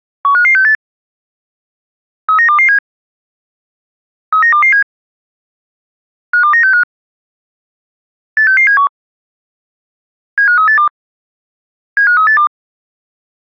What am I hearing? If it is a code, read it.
Five-tone selective call (CCIR), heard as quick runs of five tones, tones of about 100 ms. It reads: 15568 39227 39227 52965 86671 75382 75382